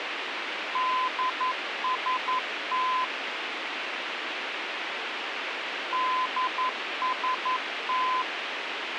Morse code, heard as a keyed tone, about 11 wpm, 1020 Hz, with radio hiss and a squelch burst at the end. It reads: DST DST